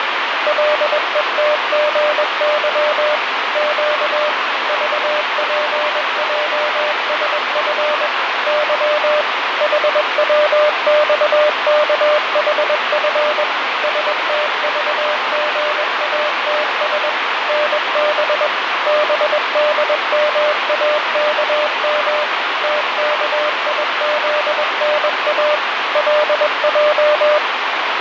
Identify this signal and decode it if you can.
Morse code, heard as a keyed tone, machine-sent, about 21 wpm, 600 Hz, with heavy radio static and fading. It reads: LETGY Q VPJSF Y HWXKHF STVGATS NB BDMAKM TKIZNA LJ